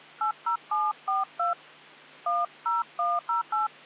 DTMF, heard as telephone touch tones, dialled by hand, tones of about 150 ms. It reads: 80742 10108